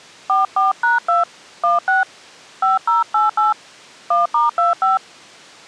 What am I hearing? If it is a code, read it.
DTMF, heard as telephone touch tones, dialled by hand, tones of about 150 ms. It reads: 44#2 16 5088 1*25